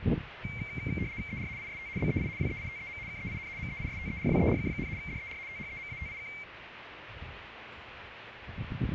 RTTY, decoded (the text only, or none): ER IST BEI WEITEM KEIN MEISTERWERK, DER THEMATIK